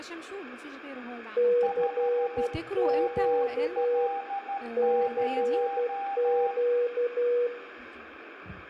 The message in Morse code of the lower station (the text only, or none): CQ CQ